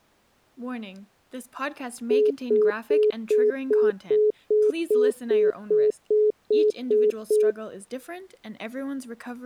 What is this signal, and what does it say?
Telephone call progress tone (single-tone plan, as in most of Europe), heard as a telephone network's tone, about 420 Hz, 0.2 s on and 0.2 s off, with speech in English. Congestion tone.